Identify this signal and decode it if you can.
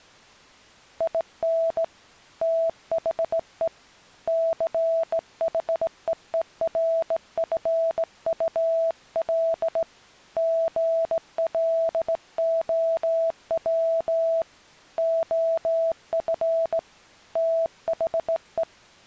Morse code, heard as a keyed tone, hand-sent with a straight key, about 17 wpm, 660 Hz. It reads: IN THE CHEERFUL GLOW OF THE